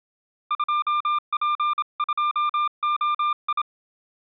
Morse code, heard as a keyed tone, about 27 wpm, 1200 Hz. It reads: 2P2OI